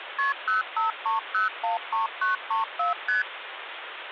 Multi-frequency trunk signalling (R1, as on North American trunks), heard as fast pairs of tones, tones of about 140 ms, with phone line noise. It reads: KP 053013934 ST